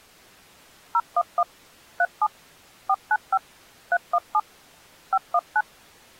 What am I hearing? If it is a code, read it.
DTMF, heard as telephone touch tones, dialled by machine, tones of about 50 ms. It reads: 011 37 495 317 519